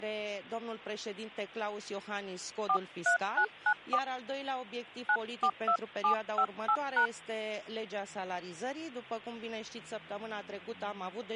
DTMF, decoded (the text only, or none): 43994 942758#